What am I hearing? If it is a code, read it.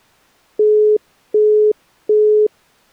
Telephone call progress tone (as in the UK, Australia and similar networks), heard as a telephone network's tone, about 420 Hz, 0.375 s on and 0.375 s off. Busy tone.